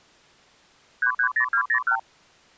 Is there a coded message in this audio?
Yes: multi-frequency trunk signalling (R2, with the far end's replies) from 1.0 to 2.0 s, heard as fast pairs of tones, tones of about 80 ms. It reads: 330201